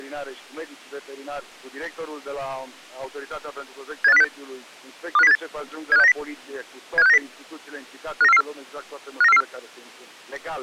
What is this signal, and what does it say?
Five-tone selective call (EEA), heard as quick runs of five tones, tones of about 40 ms. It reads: 78506 25078 75690 75690 59444 59444